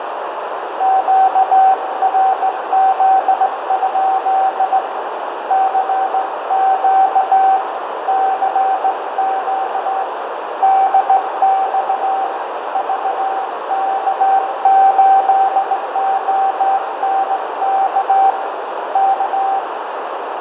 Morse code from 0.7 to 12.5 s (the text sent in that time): QRZ? CQ CQ DX